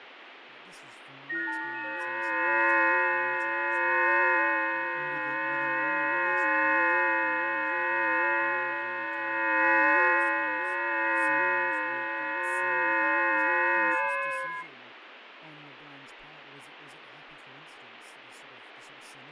FT8 (several signals at once), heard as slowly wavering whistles, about 6.25 baud, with radio static, fading and speech in English.